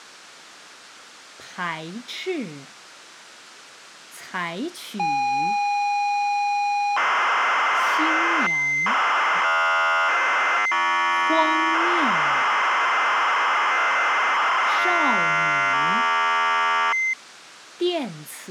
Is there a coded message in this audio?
Yes: ZX Spectrum tape loading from 5.0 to 17.1 s, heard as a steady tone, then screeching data.